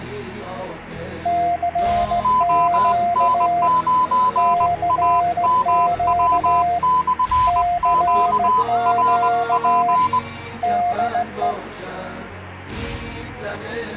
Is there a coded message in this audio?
Yes: Morse code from 1.2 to 11.6 s, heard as two keyed tones. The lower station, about 16 wpm, 700 Hz: CQ CQ CQ DE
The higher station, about 20 wpm, 1010 Hz: ON9AMW/QRP